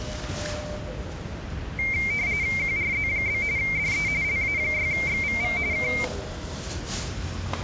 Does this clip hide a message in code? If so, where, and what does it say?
Yes: RTTY (45.45 baud, 170 Hz shift) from 1.8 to 6.0 s, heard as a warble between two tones, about 2200 Hz centre, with the noise of a residential street. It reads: QRZ? DE LA6XVV K